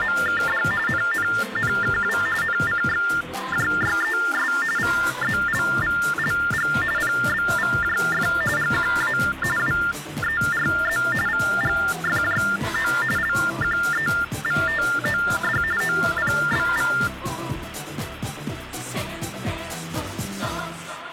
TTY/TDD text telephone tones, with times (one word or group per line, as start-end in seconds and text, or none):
0.0-0.6 …
0.9-2.2 NNNKW
2.4-4.5 NCXJYES
4.8-6.7 VZLVLG
7.0-8.3 PBVJF
8.6-9.2 GQA
9.6-11.0 WERZ
11.3-12.9 VGFJO
13.2-15.6 LQEVTOD
15.8-16.9 OPBV